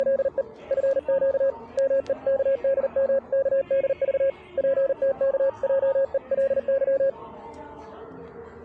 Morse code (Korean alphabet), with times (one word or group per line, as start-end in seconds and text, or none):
0.0-0.4 …
0.7-1.5 내
1.8-4.3 마음을
4.6-7.1 정하게